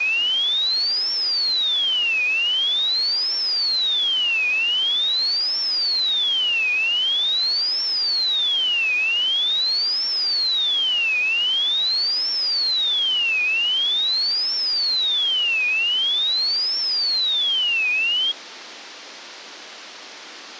A tone that sweeps in pitch again and again, with phone line noise. There is no code.